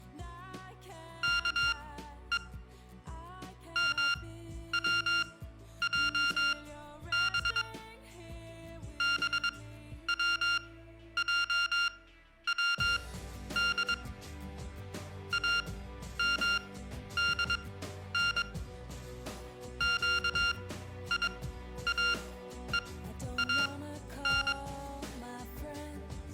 Morse code (Persian alphabet), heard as electronic beeps, machine-sent, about 22 wpm, spaced as for 11 wpm, 1400 Hz, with room echo. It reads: که موجب بوجود امدن گیاهان